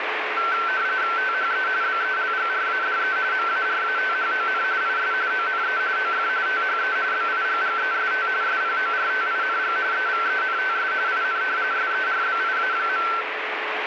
RTTY (45.45 baud, 170 Hz shift), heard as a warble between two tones, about 1440 Hz centre, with radio static. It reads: THE BELGRADE MARATHON IS ONE OF THE BIGGEST SPORTING EVENTS IN SERBIA.